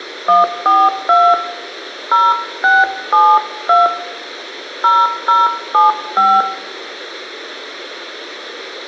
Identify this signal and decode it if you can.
DTMF, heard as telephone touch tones, dialled by hand, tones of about 200 ms, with a squelch burst at the end and room echo. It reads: 142 0672 0075